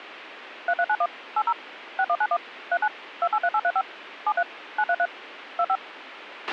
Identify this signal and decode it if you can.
DTMF, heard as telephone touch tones, dialled by machine, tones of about 60 ms, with radio hiss and a squelch burst at the end. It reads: 3391 80 6191 39 283835 73 933 25